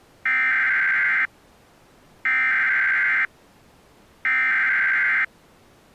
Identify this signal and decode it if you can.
Emergency Alert System (SAME) tones (header bursts), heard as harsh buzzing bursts, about 520.83 baud.